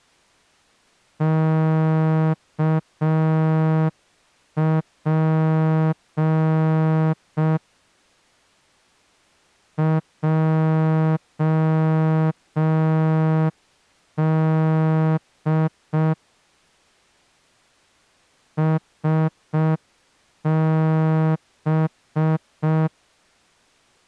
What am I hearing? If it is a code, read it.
Morse code, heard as a horn, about 5 wpm. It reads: KP JD SB